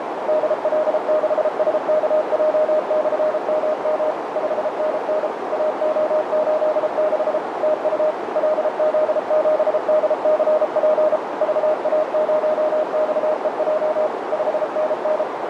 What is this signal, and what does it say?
Morse code, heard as a keyed tone, machine-sent, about 33 wpm, 620 Hz, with heavy radio static and a narrow filter. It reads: DL6SKJ/MM 5NN AO86 TU LZ7DCP VA0XEJ 5NN